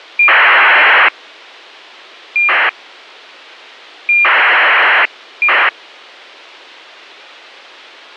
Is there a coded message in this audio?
Yes: ACARS aircraft data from 0.2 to 5.7 s, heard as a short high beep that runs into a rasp, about 2400 baud.